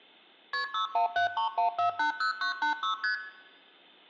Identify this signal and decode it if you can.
Multi-frequency trunk signalling (R1, as on North American trunks), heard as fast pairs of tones, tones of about 110 ms, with room echo. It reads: KP 61731480986 ST